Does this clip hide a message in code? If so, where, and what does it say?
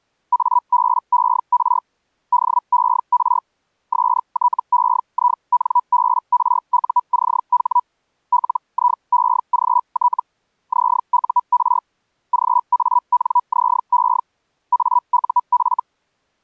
Yes: Hellschreiber (Feld-Hell, 122.5 baud) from 0.3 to 15.8 s, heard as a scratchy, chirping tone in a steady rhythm, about 980 Hz. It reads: ABER DER STEINBRUCH LIEGT ZUR GANZE AUF